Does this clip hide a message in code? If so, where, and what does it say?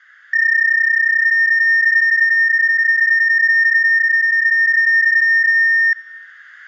Yes: PSK31 (31.25 baud) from 0.3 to 5.9 s, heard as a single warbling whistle, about 1800 Hz, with room echo.